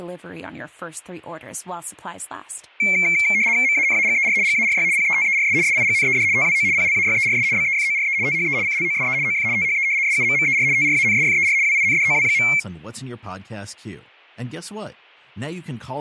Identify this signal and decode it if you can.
RTTY (75 baud, 170 Hz shift), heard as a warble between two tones, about 2250 Hz centre, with speech in English. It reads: MANAGER GARY PETERS SIGNED TWO PLAYERS BEFORE THE CLOSE OF THE SUMMER TRANSFER WINDOW.